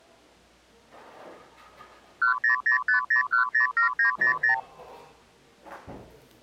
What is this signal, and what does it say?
Multi-frequency trunk signalling (R2, with the far end's replies), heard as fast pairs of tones, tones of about 110 ms, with the noise of a cafe. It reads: 10050107900